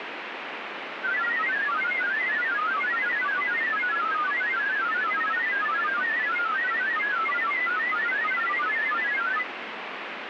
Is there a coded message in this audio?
Yes: multi-tone FSK (Olivia or MFSK type), about 1000 Hz wide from 1.0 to 9.5 s, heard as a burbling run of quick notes, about 31.25 baud, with radio static.